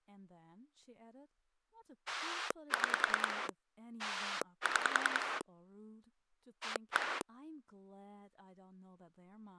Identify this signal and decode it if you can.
Pulse dialling, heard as a rotary dial, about 10 pulses a second, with speech in English. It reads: 6 6 1